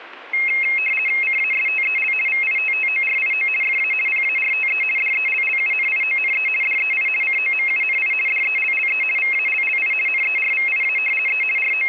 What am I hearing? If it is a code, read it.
RTTY (50 baud, 450 Hz shift), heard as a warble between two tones, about 2350 Hz centre. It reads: CASTEL VITTORIO FA PARTE DELLUNIONE DEI COMUNI DELLE VALLI NERVIA E …